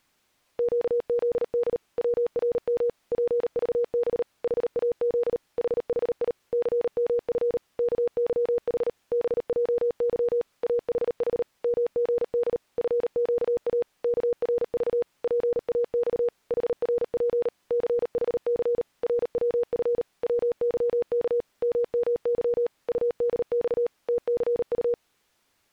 Morse code, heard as a keyed tone, machine-sent, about 38 wpm, 480 Hz. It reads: QZD WRM PVB HAZ HHI CMF KYH BJY AHH MGD FQA KRV PAX HRP CHC RWF WYK MMY UDX TCU